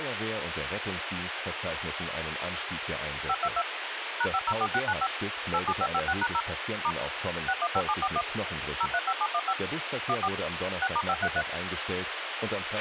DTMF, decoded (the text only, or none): 522 #504695 87556#0 * 615741 035715 14 6*533